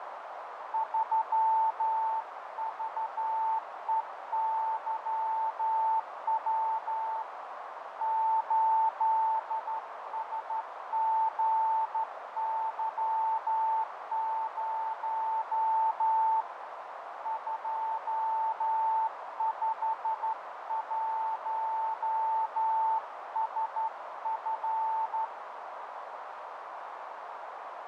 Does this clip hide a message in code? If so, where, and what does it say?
Yes: Morse code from 0.7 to 25.3 s, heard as a keyed tone, hand-sent with a straight key, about 12 wpm, 890 Hz, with radio static, fading and a narrow filter. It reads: 3VEYW 8SGY0 251SF